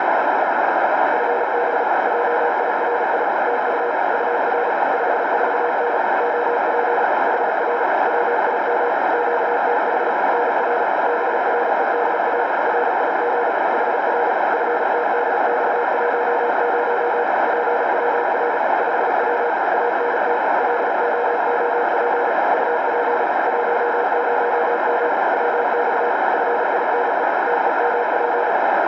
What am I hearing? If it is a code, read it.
Morse code, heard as a keyed tone, machine-sent, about 36 wpm, 480 Hz, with heavy radio static and a narrow filter. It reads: FB JIRI TU UR 54N OP HR WIM QTH NR BREDA RIG HR FTDX10 PWR 5W ANT LOOP UP 10M WX FINE TEMP